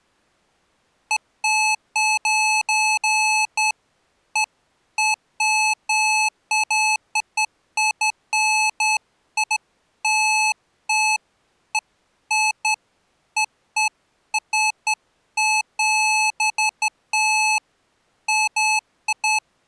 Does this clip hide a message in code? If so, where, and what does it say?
No, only beeps of irregular length.